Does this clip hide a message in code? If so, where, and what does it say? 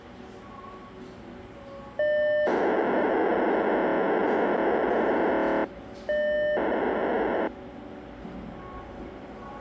Yes: POCSAG pager data (1200 baud) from 2.0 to 7.5 s, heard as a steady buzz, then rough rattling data, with the noise of a cafe.